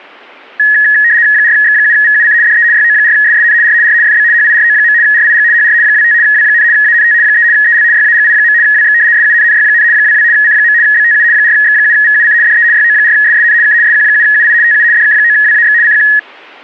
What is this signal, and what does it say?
RTTY (75 baud, 170 Hz shift), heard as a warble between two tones, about 1800 Hz centre. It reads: 4X7VUC DE YO4SSN R R FB HIRO. RIG HR 25 W, ANT 3 EL YAGI. WX SUNNY, 22 C. BTU 4X7VUC DE YO4SSN K SQ7UI TU DK9WAX CQ